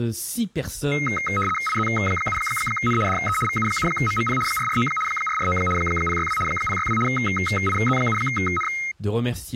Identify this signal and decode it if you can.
RTTY (75 baud, 850 Hz shift), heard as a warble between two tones, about 1700 Hz centre, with speech in French. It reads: IZ7N DE VU7MMP 449 449 062 062 IZ7N